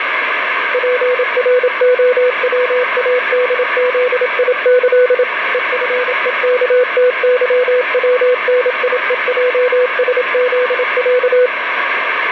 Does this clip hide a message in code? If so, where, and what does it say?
Yes: Morse code (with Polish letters) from 0.7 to 11.5 s, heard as a keyed tone, machine-sent, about 27 wpm, 500 Hz, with radio static. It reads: PROWADZIĆ EFEKTYWNIEJSZĄ